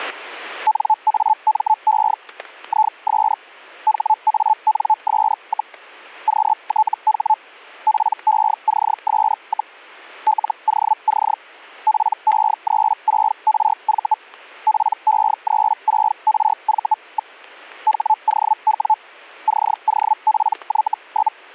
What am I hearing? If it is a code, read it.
Hellschreiber (Feld-Hell, 122.5 baud), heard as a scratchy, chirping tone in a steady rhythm, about 870 Hz, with static crashes. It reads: NAME IS HANS, QTH PECS, LOC PE36RV PE36RV. HOW COPY?